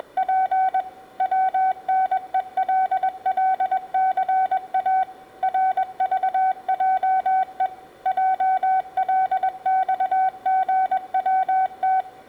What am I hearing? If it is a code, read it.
Morse code, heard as a keyed tone, machine-sent, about 21 wpm, 760 Hz, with room echo. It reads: … WNELLCA RVJE JLXGWT